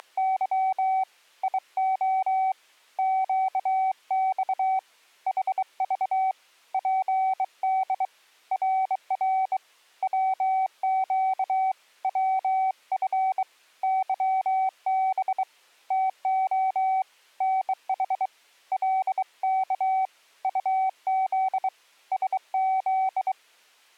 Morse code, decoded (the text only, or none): … IO QX HV PD RR WQ WF YB TO NH LK UZ SZ